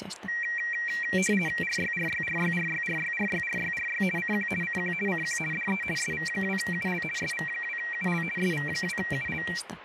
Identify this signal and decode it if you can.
RTTY (50 baud, 450 Hz shift), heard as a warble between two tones, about 2100 Hz centre, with radio static and speech in Finnish. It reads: RYRYRYRYRYRYRYRY CQ CQ CQ DE SV2UL SV2UL SV2UL